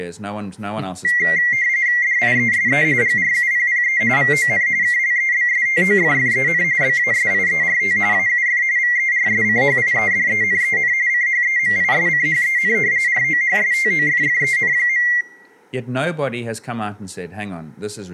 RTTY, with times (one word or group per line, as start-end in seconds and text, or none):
2.0-2.8 DIESE
3.0-4.0 GRUPPE
4.2-4.7 VON
4.8-6.6 KLEBSTOFFEN
6.8-8.0 BASIERT
8.1-8.6 AUF
8.8-10.9 VERSCHIEDENEN
11.1-12.7 CHEMISCHEN
13.1-15.1 ROHSTOFFEN.